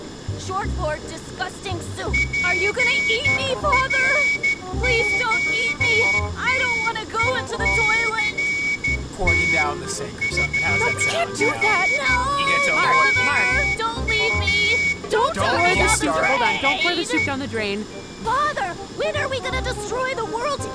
Morse code, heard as a whistle, hand-sent with a straight key, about 13 wpm, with room echo. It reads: PROTECT FROM THE